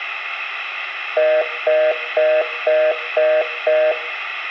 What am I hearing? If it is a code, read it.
Telephone call progress tone (North American plan), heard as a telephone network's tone, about 480, 620 Hz, 0.25 s on and 0.25 s off, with hum. Congestion tone.